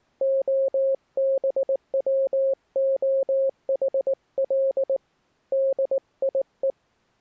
Morse code, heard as a keyed tone, hand-sent with a paddle, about 19 wpm, 540 Hz. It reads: OBWOHL DIE